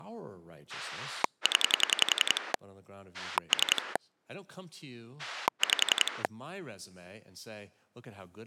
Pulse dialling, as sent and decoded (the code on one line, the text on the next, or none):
10 / 3 / 5
0 3 5